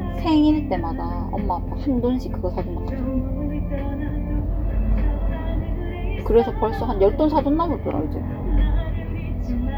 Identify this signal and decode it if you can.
The noise inside a car. There is no code.